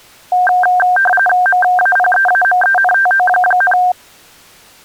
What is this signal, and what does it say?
RTTY (45.45 baud, 850 Hz shift), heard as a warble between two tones, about 1150 Hz centre. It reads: MAPEAMENTO,